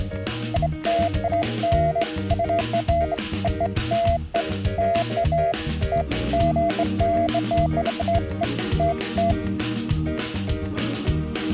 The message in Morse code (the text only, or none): none